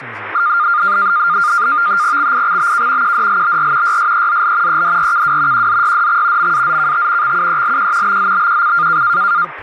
NAVTEX (SITOR-B), 100 baud, 170 Hz shift, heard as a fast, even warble, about 1310 Hz centre, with radio static and speech in English. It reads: XIXBK QDLBR YSEZL EDRKW QZYDX MAZKT XUELQ BZBQC